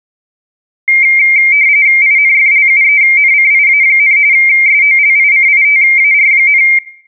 RTTY (45.45 baud, 170 Hz shift), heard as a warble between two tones, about 2200 Hz centre. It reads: INFLUENCIA, SOLICITAR,